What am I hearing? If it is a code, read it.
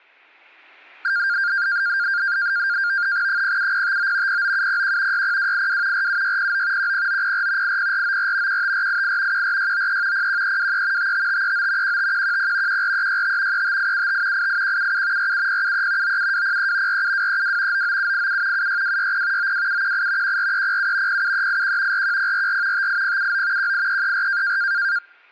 NAVTEX (SITOR-B), 100 baud, 170 Hz shift, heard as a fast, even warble, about 1500 Hz centre. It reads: 07059 09701 60282 47609 10904 80494 15488 14693 01323 55539 15110 14365 35875 88177 47073 97203 47232 99787 76260 92718 14307 07381 41044 58079 18334